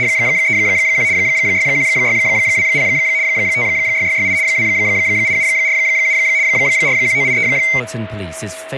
RTTY (75 baud, 170 Hz shift), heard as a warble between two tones, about 2150 Hz centre, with a steady whistle near 640 Hz and speech in English. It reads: … 61620 56668 28747 41983